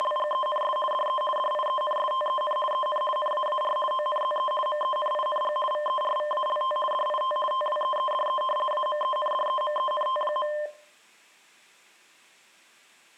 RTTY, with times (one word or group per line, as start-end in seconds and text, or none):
0.0-0.8 …
0.9-1.2 DE
1.4-2.6 DIENSTEN
2.7-3.0 EN
3.2-3.8 NAAR
3.9-4.5 ONZE
4.7-5.6 MENING
5.7-6.8 VERVALT
6.9-7.4 DIT
7.5-8.4 TWEEDE
8.7-10.5 AMENDEMENT.